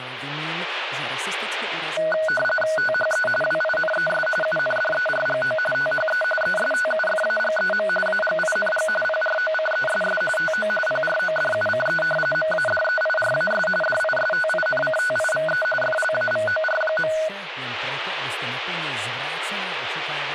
RTTY (45.45 baud, 850 Hz shift), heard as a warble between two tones, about 1060 Hz centre, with radio static and speech in Czech. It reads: THE WINES UNDERGO THE ESTUFAGEM AGING PROCESS TO PRODUCE MADEIRAS DISTINCTIVE FLAVOR.